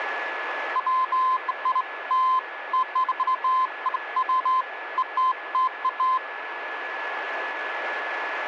Beeps of irregular length, with radio static and a steady whistle near 1710 Hz. There is no code.